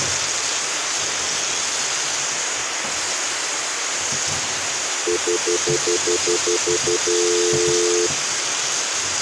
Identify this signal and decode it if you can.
Telephone call progress tone (North American plan), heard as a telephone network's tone, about 350, 440 Hz, 0.1 s on and 0.1 s off, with phone line noise and kitchen noise. Stutter dial tone.